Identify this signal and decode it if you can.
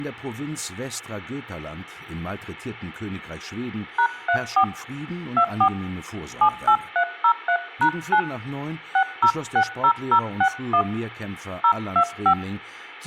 DTMF, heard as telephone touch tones, dialled by hand, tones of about 80 ms. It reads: #34 24 78303#9 6060061 025